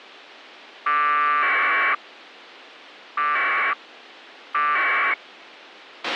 Packet radio (AX.25, as in APRS), 1200 baud, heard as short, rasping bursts, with a squelch burst at the end.